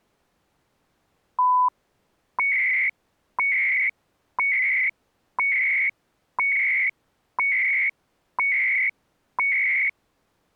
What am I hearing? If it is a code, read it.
Radio time signal (CHU, Canada), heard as beeps and data bursts, one a second.